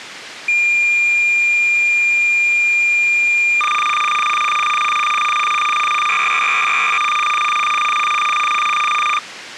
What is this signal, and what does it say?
Cassette data (Kansas City type), 300 baud, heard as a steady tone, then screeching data.